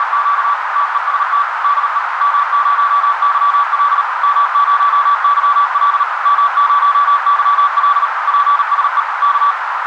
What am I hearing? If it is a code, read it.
Morse code, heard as a keyed tone, machine-sent, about 38 wpm, 1150 Hz, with heavy radio static and a narrow filter. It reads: … TEST DE M0YL M0YL M0YL PSE K